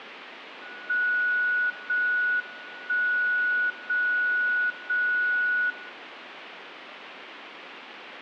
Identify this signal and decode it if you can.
Radio time signal (JJY), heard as a tone whose level steps once a second, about 1470 Hz. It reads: 0 1 0 0 0